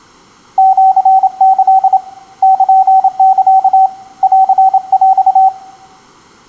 Morse code (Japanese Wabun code), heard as a keyed tone, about 27 wpm, 760 Hz, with room echo. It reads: シキ ルサ ンヰ